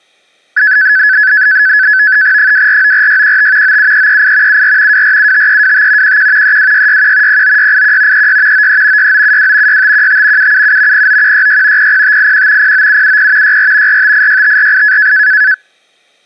NAVTEX (SITOR-B), 100 baud, 170 Hz shift, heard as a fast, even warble, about 1600 Hz centre. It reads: 2494615 97338 74 2475325 11 32661 09681 36 93 6972 6515 777 09166 00581 09770 64 4586548